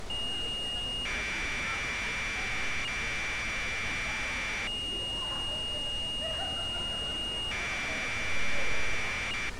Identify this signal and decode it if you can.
Commodore tape loading (standard loader), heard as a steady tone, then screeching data, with tape hiss and street noise.